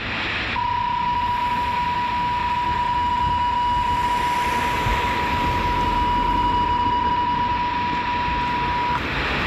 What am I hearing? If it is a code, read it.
PSK31 (31.25 baud), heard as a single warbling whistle, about 970 Hz, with radio static and street noise.